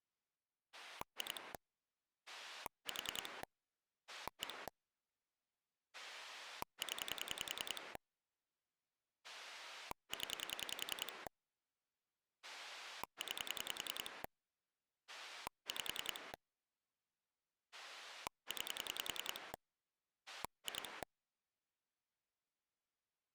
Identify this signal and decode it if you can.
Pulse dialling, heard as a rotary dial, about 10 pulses a second. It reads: 2 4 1 0 0 9 5 9 2